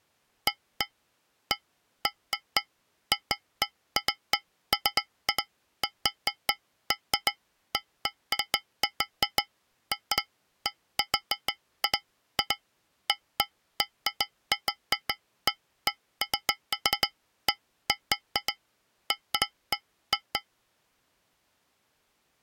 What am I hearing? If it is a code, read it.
Irregular taps on a metal pipe. There is no code.